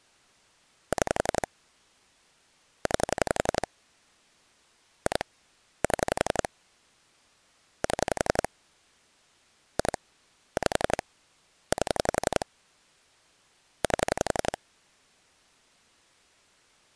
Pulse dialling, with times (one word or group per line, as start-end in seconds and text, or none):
0.9-1.5 6
2.9-3.7 9
5.1-5.2 2
5.8-6.5 7
7.8-8.5 7
9.8-10.0 2
10.6-11.0 5
11.7-12.5 8
13.8-14.6 8